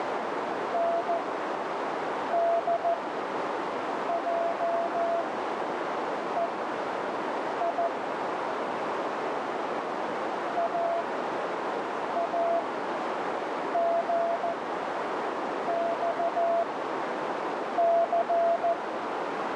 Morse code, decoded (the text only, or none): NDJEI AAGXC